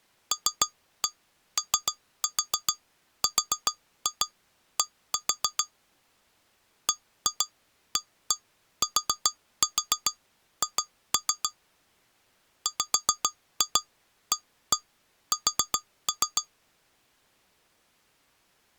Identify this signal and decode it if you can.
Tap code, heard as taps on glass, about 7 knocks a second. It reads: LORD BATH WAS